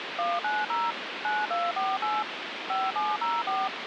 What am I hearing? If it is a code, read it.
DTMF, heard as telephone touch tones, dialled by machine, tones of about 210 ms, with phone line noise. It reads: 190 9248 5704